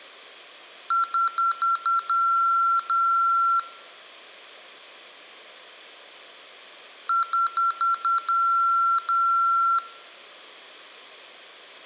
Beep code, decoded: 5 short, 2 long

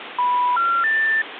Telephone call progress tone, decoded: special information tone

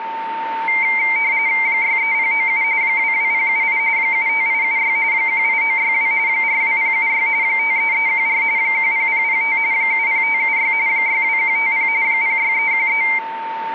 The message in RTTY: 63097 22078 75876 18962 42076 53314 10005 70576 62150 06313

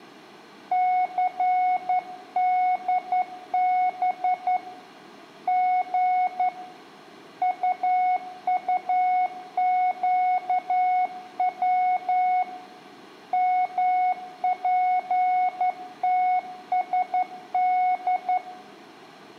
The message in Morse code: CDB G UUQW MPTSD

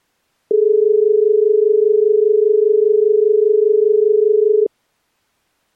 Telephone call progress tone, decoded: dial tone

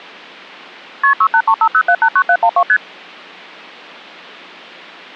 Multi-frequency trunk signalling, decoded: KP 68350789712 ST

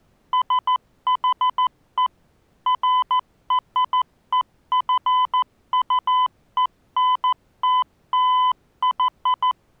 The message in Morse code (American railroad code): SHE FREQUENTLY

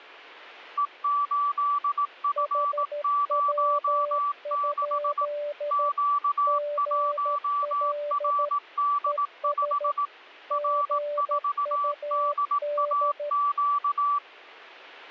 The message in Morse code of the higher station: E8F06 Q1RD5 R4DAQ

